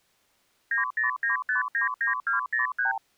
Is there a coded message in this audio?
Yes: multi-frequency trunk signalling (R2, with the far end's replies) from 0.7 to 3.0 s, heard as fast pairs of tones, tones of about 130 ms. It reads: 909599203